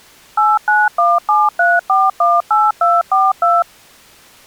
DTMF, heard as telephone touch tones, dialled by machine, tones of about 200 ms. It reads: 89173418242